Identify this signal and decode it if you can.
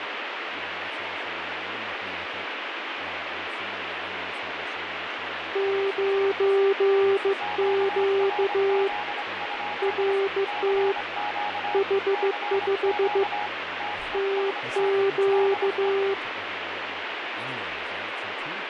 Morse code, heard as two keyed tones, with radio static and speech in English. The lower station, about 15 wpm, 390 Hz: 9Q RT H5 TQ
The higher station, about 25 wpm, 830 Hz: QRZ? CQ CQ TEST DE